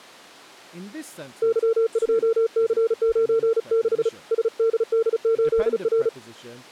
Morse code, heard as a keyed tone, hand-sent with a paddle, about 35 wpm, 450 Hz. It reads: Y2C96 SDD8R